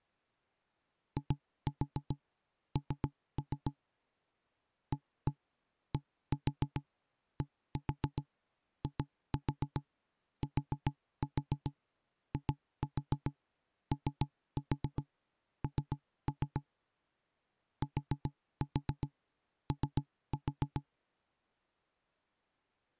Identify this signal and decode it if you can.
Tap code, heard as knocks on wood, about 7 knocks a second. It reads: IN ADDITION TO